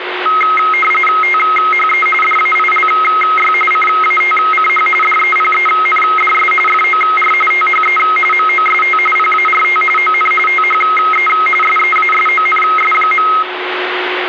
RTTY (45.45 baud, 850 Hz shift), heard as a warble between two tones, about 1700 Hz centre, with radio static and a steady whistle near 360 Hz. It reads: THE DAILY CATCH DEPENDS FOR THE MOST PART ON THE SEASONS.